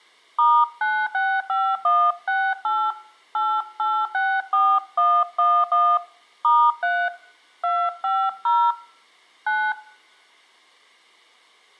DTMF, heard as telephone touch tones, dialled by hand, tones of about 260 ms, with room echo. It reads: *965168 8864111 *3 250 9